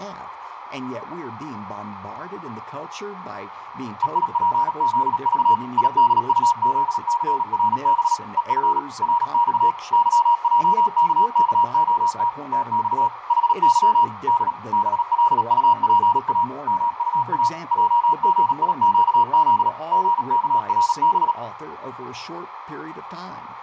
Morse code, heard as a keyed tone, machine-sent, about 37 wpm, 950 Hz, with radio static, fading, a narrow filter and room echo. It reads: EIPZV IDUZCRB EF RX YJKKOT TX HY D BLUPA MUA JGIQZ GKRB